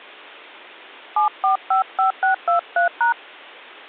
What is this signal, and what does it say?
DTMF, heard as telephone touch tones, dialled by hand, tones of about 120 ms. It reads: 7455623#